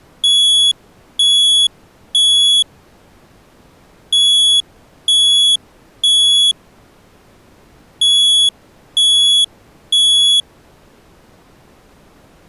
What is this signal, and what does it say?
Alarm pattern, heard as an alarm's beeps, played three times, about 3400 Hz. Temporal three. Smoke or fire, evacuate.